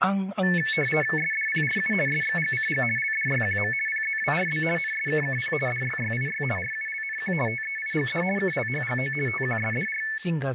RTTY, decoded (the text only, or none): SDPRU SXGCG LDYQM PZWRB NSKKP DYYIY RULNQ TEIGD KLHGO TQSDR